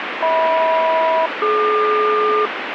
Aircraft SELCAL, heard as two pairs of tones, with radio static. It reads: HM-DQ